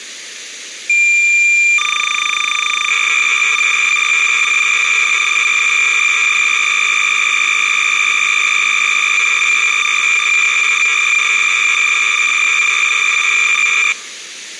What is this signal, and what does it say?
Cassette data (Kansas City type), 300 baud, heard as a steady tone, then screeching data.